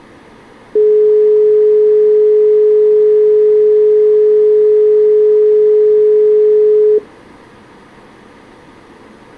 Telephone call progress tone (425 Hz plan, as in most of Europe), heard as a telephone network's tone, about 420 Hz. Dial tone.